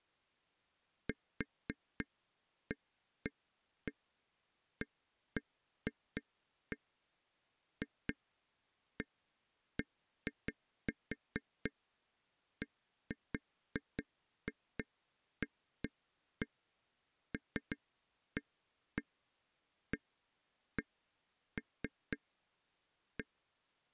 Irregular taps on a table. There is no code.